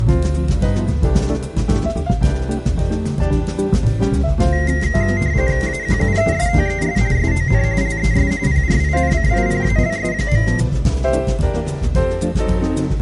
RTTY (45.45 baud, 170 Hz shift), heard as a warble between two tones, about 2000 Hz centre. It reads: AQUESTES SON LES PRINCIPALS.